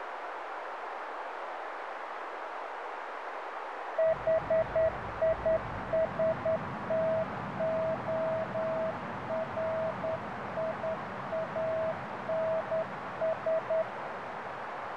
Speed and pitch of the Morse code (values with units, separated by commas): 10 wpm, 650 Hz